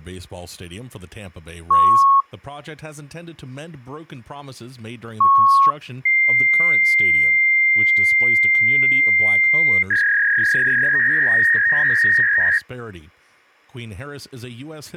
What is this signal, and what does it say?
Fax machine handshake, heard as beeps, a long tone and a warble, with speech in English.